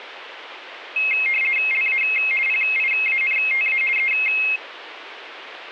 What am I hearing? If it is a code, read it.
RTTY (50 baud, 450 Hz shift), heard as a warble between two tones, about 2350 Hz centre. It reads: LA PIANTA E